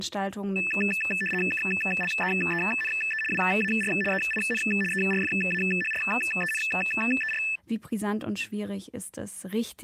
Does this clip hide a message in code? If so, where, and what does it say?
Yes: RTTY (75 baud, 850 Hz shift) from 0.6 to 7.6 s, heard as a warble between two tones, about 2200 Hz centre, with speech in German. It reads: KLEENE WAR EIN ERFAHRENER